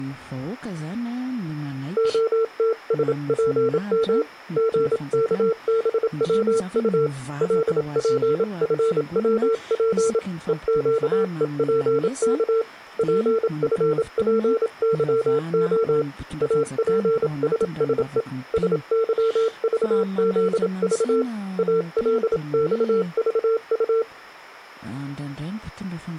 Morse code, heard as a keyed tone, hand-sent with a paddle, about 27 wpm, 450 Hz. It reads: OTSPM GKBWU LPFWP EQEPK PFPYO APSSE SYVZV ALXVU